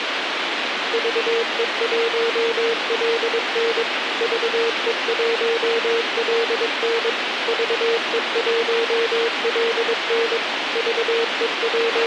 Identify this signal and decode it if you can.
Morse code, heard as a keyed tone, machine-sent, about 22 wpm, 460 Hz, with radio hiss and a squelch burst at the end. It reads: VE1LN VE1LN VE1LN …